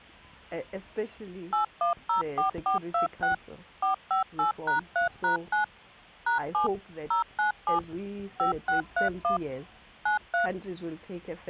DTMF, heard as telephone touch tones, dialled by machine, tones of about 120 ms. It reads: 8104426 458#3#9 #7 097 5631 93